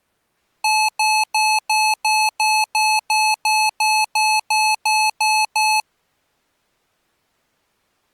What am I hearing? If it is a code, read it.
Evenly repeated beeps. There is no code.